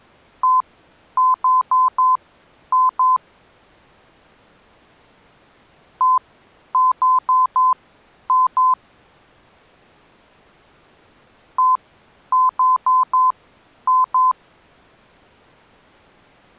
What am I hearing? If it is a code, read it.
Beep code, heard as beeps, played three times, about 1020 Hz. 1-4-2. In Phoenix BIOS tables: parity failure in the first 64 KB of memory.